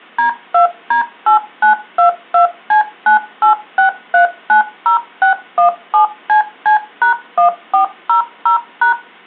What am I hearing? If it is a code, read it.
DTMF, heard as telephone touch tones, dialled by machine, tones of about 110 ms. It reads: D2D8922C986390617CC#1400#